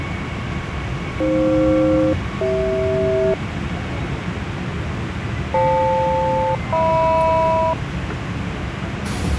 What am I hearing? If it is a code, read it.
Aircraft SELCAL, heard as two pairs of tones, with radio static and the noise inside a subway train. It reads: AF-CH FL-HM